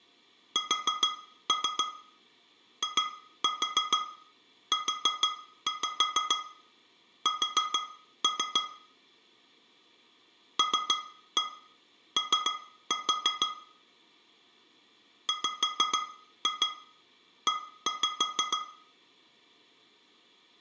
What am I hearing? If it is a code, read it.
Tap code, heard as taps on glass, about 6 knocks a second, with room echo. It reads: SIUS LO WE